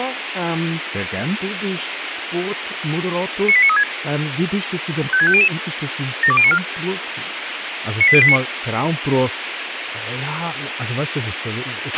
Five-tone selective call (ZVEI), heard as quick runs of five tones, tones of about 70 ms, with radio hiss and a squelch burst at the end. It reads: 98936 56500 72094 98089